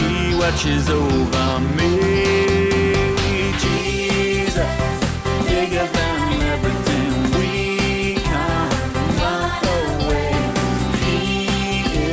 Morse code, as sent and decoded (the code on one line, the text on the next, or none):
none